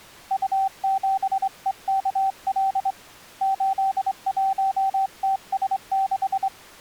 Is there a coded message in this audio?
Yes: Morse code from 0.3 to 6.5 s, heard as a keyed tone, hand-sent with a straight key, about 24 wpm, 770 Hz. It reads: U7EKL 81TS6